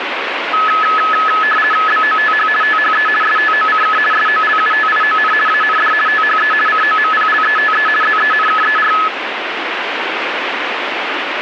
RTTY (50 baud, 450 Hz shift), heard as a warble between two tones, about 1500 Hz centre, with radio static. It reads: BOTH THE STOCK SOLUTION AND THE COMPLETE ZENKER